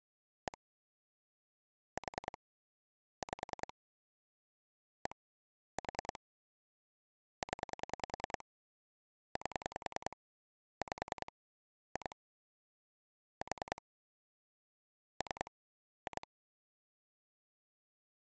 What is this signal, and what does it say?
Pulse dialling, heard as clicks on a phone line, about 10 pulses a second. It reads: 1 4 5 1 4 0 8 5 2 4 3 2